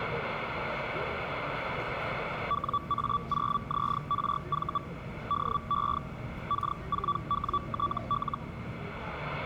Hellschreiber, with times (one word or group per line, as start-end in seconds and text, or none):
2.5-4.8 WA0ZRV
5.3-6.0 DE
6.5-8.4 K4WTL